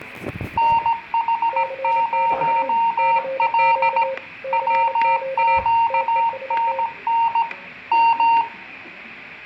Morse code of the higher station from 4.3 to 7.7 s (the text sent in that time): WQNN